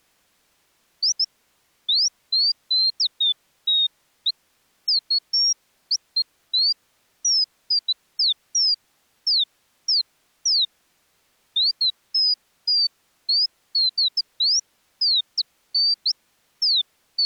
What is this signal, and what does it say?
Bird-like chirps. There is no code.